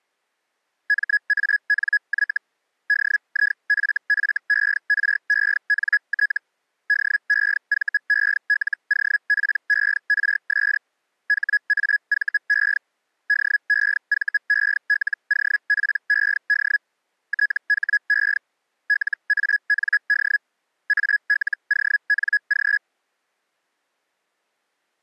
Hellschreiber (Feld-Hell, 122.5 baud), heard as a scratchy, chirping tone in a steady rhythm, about 1700 Hz. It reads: MANY DIFFERENT DEVELOPERS HAVE DEVELOPED THE LAND ALONG